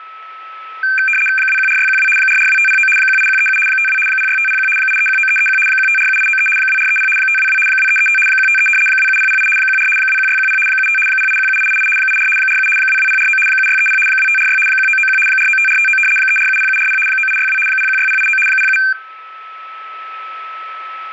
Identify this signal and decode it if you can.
RTTY (75 baud, 850 Hz shift), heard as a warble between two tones, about 1950 Hz centre, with static crashes and a steady whistle near 1300 Hz. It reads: 214612 442509 18137 52 06501 8319331 1547893 2430 522 2335 153 27008 14 21610 75 0817888 84 47 22049 7630 2546 1991 495459 3470740 9862 016089 07